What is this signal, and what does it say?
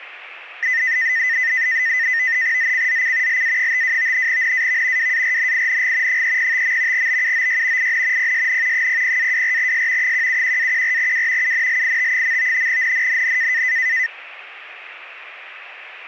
NAVTEX (SITOR-B), 100 baud, 170 Hz shift, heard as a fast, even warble, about 1900 Hz centre. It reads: ZCZC LA52 NAV WARNING 305. BUOY IN PSN 00-24S 171-14W UNLIT. NNNN